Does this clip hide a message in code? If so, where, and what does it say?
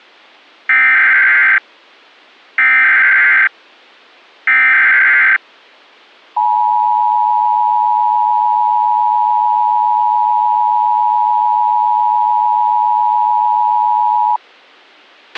Yes: Emergency Alert System (SAME) tones (header bursts, then the 853 and 960 Hz attention tone) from 0.7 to 14.4 s, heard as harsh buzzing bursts, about 520.83 baud, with a squelch burst at the end.